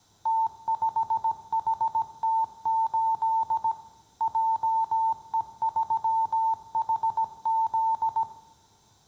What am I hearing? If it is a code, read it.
Morse code, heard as a keyed tone, machine-sent, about 17 wpm, 900 Hz, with room echo. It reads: T5HT8 JE3HZ